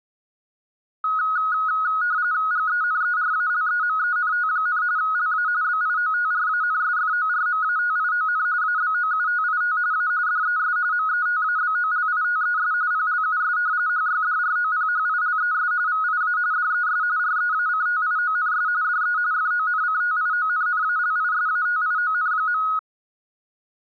RTTY (45.45 baud, 170 Hz shift), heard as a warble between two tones, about 1360 Hz centre. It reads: GENERALEMENT, LA BIOTRANSFORMATION ABOUTIT A DES METABOLITES PLUS HYDROPHILES VIA DES REACTIONS DE FONCTIONNALISATION.